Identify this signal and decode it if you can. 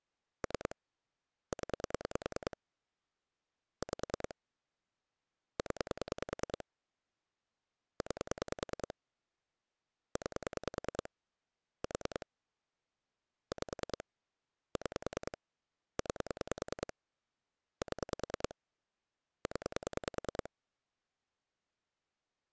Pulse dialling, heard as clicks on a phone line, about 10 pulses a second. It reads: 3 0 5 0 9 9 4 5 6 9 7 0